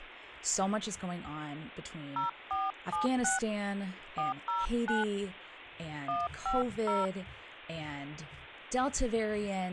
DTMF, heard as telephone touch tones, dialled by hand, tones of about 160 ms, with speech in English. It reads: 0476 409 150